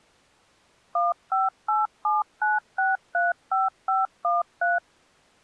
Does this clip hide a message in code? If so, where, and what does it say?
Yes: DTMF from 1.0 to 4.8 s, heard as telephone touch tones, dialled by machine, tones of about 170 ms. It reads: 15879635513